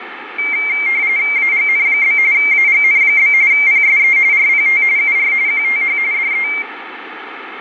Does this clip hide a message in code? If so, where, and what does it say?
Yes: RTTY (45.45 baud, 170 Hz shift) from 0.4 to 6.6 s, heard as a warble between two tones, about 2200 Hz centre, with radio static. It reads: AGN? AGN? PSE RPT UR QTH DE